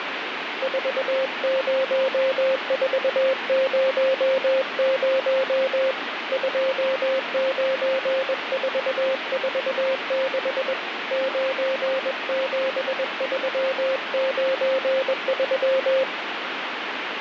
Morse code, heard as a keyed tone, hand-sent with a paddle, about 21 wpm, 530 Hz, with radio static. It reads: 40400 29446 97393